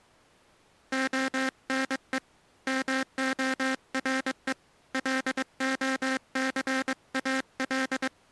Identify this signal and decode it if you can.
Morse code, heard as a buzzer, hand-sent with a paddle, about 22 wpm. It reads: ONE MORE LOCAL